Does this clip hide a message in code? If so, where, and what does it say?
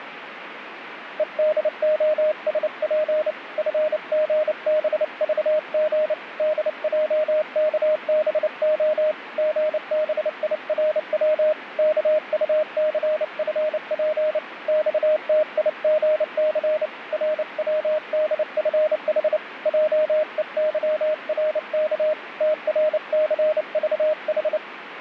Yes: Morse code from 1.1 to 24.6 s, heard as a keyed tone, hand-sent with a paddle, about 29 wpm, 620 Hz, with radio static. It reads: EDOSP FGBVG DJKBO GBIRW KUCFP XTIGC RWDFH JEYRK TRCVH